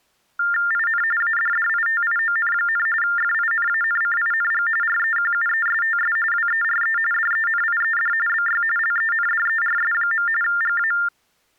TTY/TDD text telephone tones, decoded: IN ADDITION, FINANCING REQUESTS WERE DENIED BY LENDERS. GA

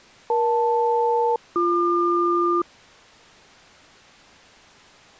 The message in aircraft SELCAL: EL-BQ

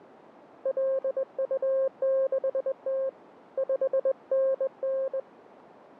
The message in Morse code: LU6T 5NN

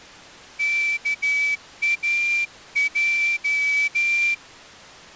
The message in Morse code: KAJ

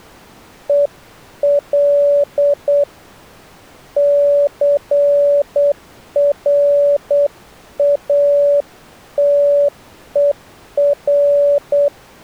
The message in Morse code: EL CRATER

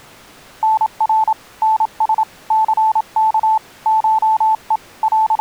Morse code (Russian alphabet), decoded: НР НС ЦК ШЕ …

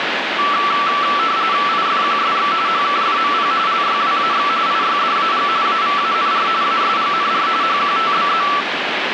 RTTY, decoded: IFQSX HKFMP LYWAX IYDAG AVANR ASGNR HQTBZ

